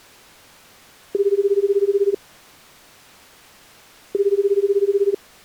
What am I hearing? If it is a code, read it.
Telephone call progress tone (Japanese plan), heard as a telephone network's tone, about 380, 400, 420 Hz, 1 s on and 2 s off. Ringback tone.